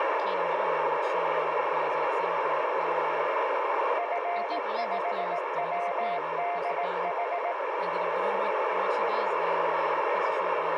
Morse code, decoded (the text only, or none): F5WDH